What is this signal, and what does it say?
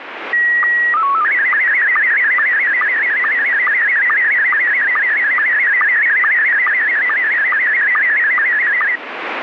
SSTV (slow-scan television), Scottie S1, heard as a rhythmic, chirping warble, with radio static.